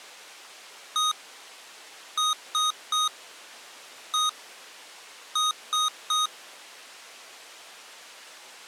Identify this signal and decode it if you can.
Beep code, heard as beeps from a small speaker, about 1250 Hz. 1-3-1-3. In Phoenix BIOS tables: keyboard controller test failure.